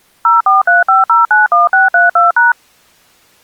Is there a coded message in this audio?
Yes: DTMF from 0.2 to 2.5 s, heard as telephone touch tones, dialled by machine, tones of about 160 ms. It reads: 0435091632#